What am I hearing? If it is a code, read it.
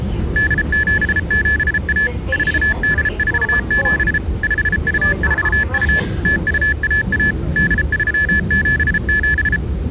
Morse code (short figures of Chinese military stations), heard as electronic beeps, machine-sent, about 33 wpm, 1700 Hz, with the noise inside a subway train. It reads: 8771 4847 5242 0211 8377